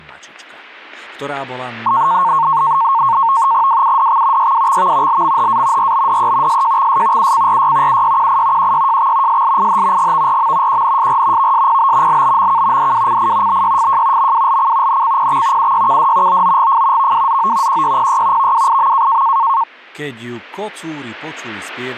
NAVTEX (SITOR-B), 100 baud, 170 Hz shift, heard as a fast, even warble, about 1000 Hz centre, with speech in Slovak. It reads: WUDX YWXV LMHA RBDE SJXS UCRY UYQI QYJX SLIH GVRM QNSR VSPB LBMK DWCI BYFJ MWLC NCPX UYKD OOGF VWZO QYPY VWIM